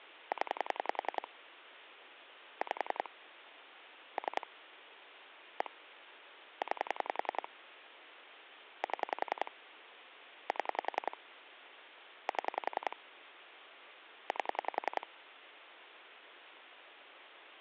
Pulse dialling, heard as clicks on a phone line, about 10 pulses a second. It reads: 0 5 3 1 9 7 7 7 8